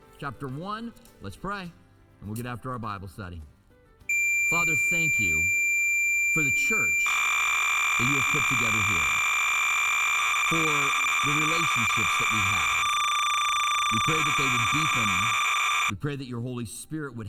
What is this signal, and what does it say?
Cassette data (Kansas City type), 300 baud, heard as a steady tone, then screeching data.